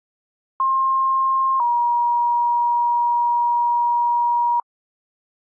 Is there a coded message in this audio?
Yes: two-tone page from 0.6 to 4.6 s, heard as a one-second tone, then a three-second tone, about 1060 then 950 Hz.